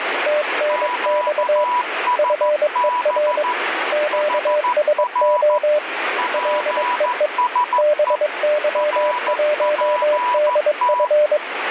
Morse code, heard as two keyed tones, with radio static. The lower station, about 22 wpm, 600 Hz: TNX FER QSO LEE BY1DF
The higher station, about 14 wpm, 980 Hz: QSB HR PSE RPT